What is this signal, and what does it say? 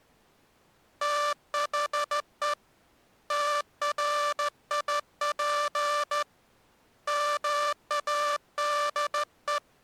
Morse code, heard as a buzzer, hand-sent with a straight key, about 14 wpm. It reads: THE TRIP MADE